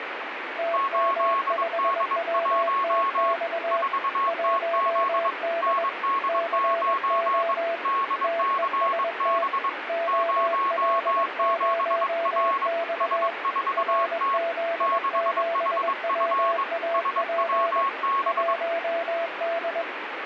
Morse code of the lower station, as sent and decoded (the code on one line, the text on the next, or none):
- -- ..... .-- - -..- / .---- -.. / -.-. --- / - . ... - / --- .-.. ----- -..- / .-. --.. --... .-- .- .--. / .---- -..
TM5WTX 1D CO TEST OL0X RZ7WAP 1D